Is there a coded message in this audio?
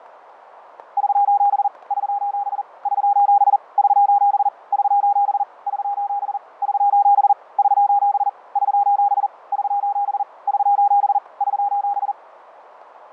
Yes: Morse code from 0.9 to 12.2 s, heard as a keyed tone, hand-sent with a paddle, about 40 wpm, 810 Hz, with radio static, fading and static crashes. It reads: <SOS> <SOS> <SOS> <SOS> <SOS> <SOS> <SOS> <SOS> <SOS> <SOS> <SOS> <SOS>